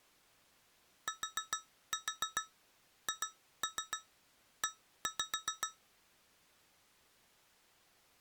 Tap code, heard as taps on glass, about 7 knocks a second. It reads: THE